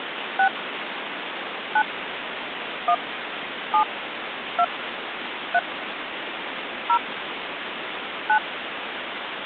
DTMF, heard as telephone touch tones, dialled by hand, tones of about 70 ms, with phone line noise. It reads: 6 9 1 7 2 3 0 9